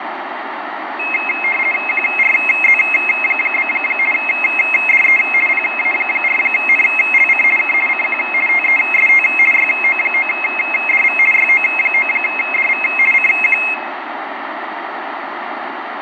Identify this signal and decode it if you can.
RTTY (50 baud, 450 Hz shift), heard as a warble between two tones, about 2350 Hz centre, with radio static and room echo. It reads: QRZ? DE PA4NLC K CQ TEST YO9DV YO9DV CQ